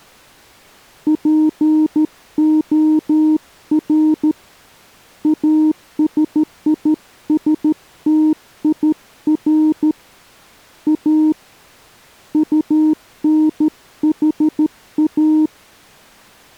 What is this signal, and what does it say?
Morse code, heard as a keyed tone, hand-sent with a straight key, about 13 wpm, 310 Hz. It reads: POR ASISTIR A UNHA